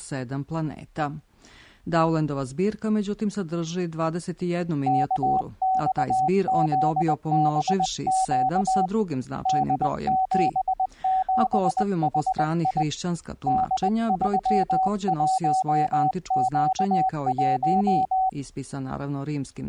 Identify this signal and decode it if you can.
Morse code, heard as a keyed tone, hand-sent with a paddle, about 20 wpm, 760 Hz. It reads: KXZBQ D77HI D31Q1